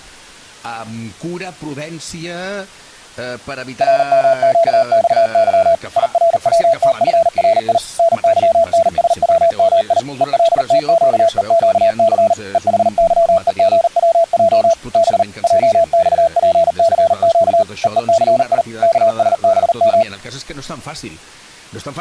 Morse code, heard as a keyed tone, machine-sent, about 39 wpm, 660 Hz. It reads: RMQXY IRWTFRI NYNSWMI ELTQEQC EHYEGWJ B JXPCQ EECI KSBM